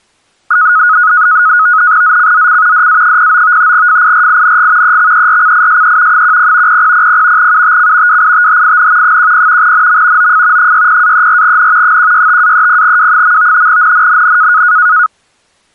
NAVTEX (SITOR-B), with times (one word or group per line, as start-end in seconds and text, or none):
2.0-2.9 ZCZC
2.7-3.7 DA09
3.7-5.0 FIRING
4.8-6.2 EXERCISE
6.1-6.8 10
6.7-7.5 0000
7.4-8.2 UTC
8.1-9.2 WITHIN
9.0-9.7 10
9.6-10.3 NM
10.2-10.7 OF
10.6-12.0 60-34N
11.8-13.7 165-30W.
13.7-14.6 NNNN